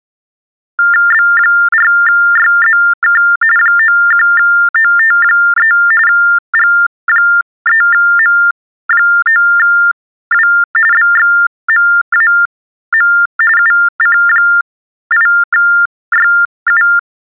TTY/TDD text telephone tones (45.45 baud Baudot), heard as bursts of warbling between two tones, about 400 Hz shift, 1600 Hz centre. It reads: B4YZK 91OT3 G3M9W BXMAM UC8YU